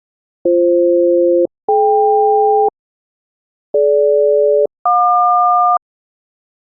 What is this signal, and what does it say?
Aircraft SELCAL, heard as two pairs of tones. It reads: BF-DK DG-JQ